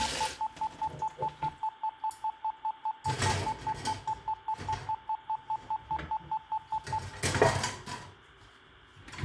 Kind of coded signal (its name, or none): none